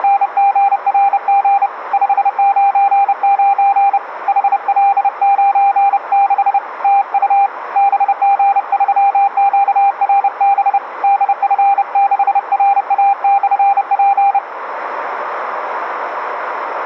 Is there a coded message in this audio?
Yes: Morse code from 0.0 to 14.4 s, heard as a keyed tone, hand-sent with a bug key, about 30 wpm, 800 Hz, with radio static. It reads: … 599 HL96 TU BG3QRB DF6RA/P